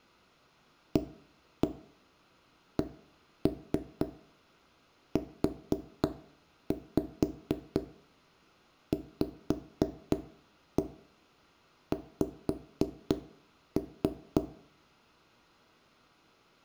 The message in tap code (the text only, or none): ACUVX